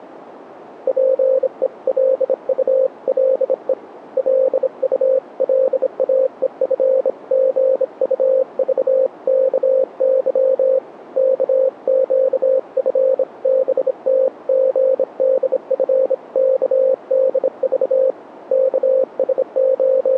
Morse code (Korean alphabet), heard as a keyed tone, hand-sent with a bug key, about 26 wpm, 530 Hz, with radio static. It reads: 자기가 기관실에 앤더슨을 …